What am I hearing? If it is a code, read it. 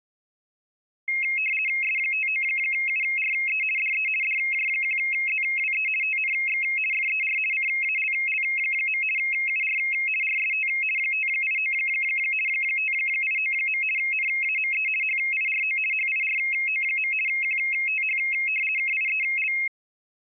RTTY (50 baud, 450 Hz shift), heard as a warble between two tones, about 2350 Hz centre. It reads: S59URE DE DJ1ZWE TNX FER CALL. UR RST 589 589. NAME HIRO HIRO. QTH KIEL